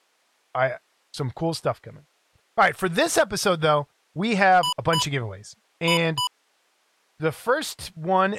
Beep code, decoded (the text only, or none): 2-2